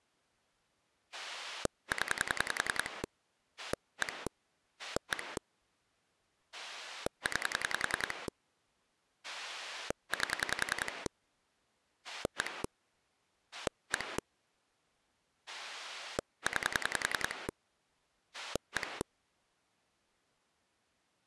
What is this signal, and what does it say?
Pulse dialling, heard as a rotary dial, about 10 pulses a second. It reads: 0 1 1 9 8 1 1 9 1